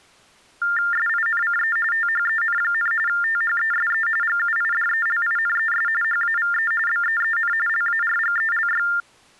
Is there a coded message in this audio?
Yes: TTY/TDD text telephone tones (45.45 baud Baudot) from 0.6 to 9.0 s, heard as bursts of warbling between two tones, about 400 Hz shift, 1600 Hz centre. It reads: SINCE THEN, THESE GUIDELINES HAVE BEEN LARGELY